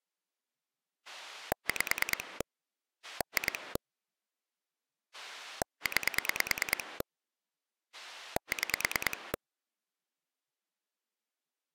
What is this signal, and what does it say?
Pulse dialling, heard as a rotary dial, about 9 pulses a second. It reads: 5 2 9 6